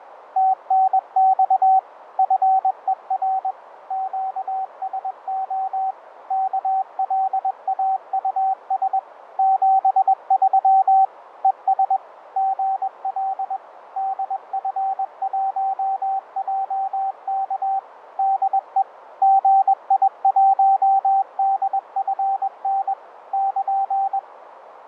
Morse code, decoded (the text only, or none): TNX FER QSO KLAUS 73 ES GL DF1JK DE GI1DFN <KN>